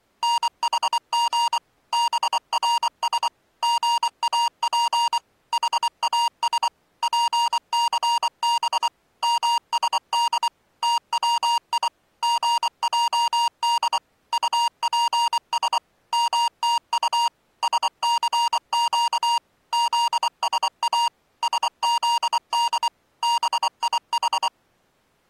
Morse code (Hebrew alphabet), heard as electronic beeps, machine-sent, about 24 wpm, 940 Hz. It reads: נחג ברש גאף חאש פסב משד תצי געד טפש מתט שסק זשא שזד ביח